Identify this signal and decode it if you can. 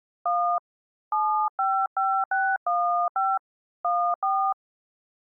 DTMF, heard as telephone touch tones, dialled by hand, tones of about 300 ms. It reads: 1 755615 14